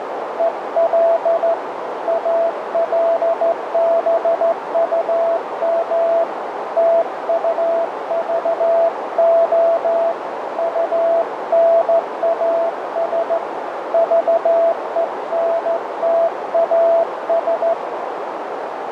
Morse code, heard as a keyed tone, hand-sent with a straight key, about 14 wpm, 670 Hz, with heavy radio static and a narrow filter. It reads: EL ALBUM TUVO UNAS VENTAS